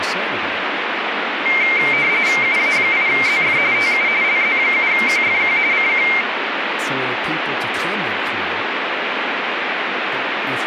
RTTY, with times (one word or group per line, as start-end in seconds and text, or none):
2.4-3.6 UA8ZF
3.7-4.1 TU
4.2-5.6 LZ7QFQ
5.7-6.1 CQ